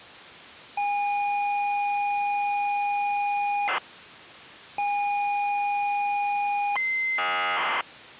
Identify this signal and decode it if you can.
ZX Spectrum tape loading, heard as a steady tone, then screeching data.